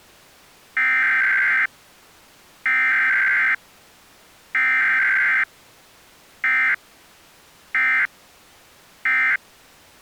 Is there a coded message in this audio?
Yes: Emergency Alert System (SAME) tones (header bursts, then end-of-message bursts) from 0.8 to 9.4 s, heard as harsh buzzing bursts, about 520.83 baud.